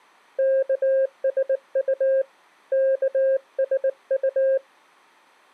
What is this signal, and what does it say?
Morse code (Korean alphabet), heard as a keyed tone, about 19 wpm, 530 Hz. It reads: 예 예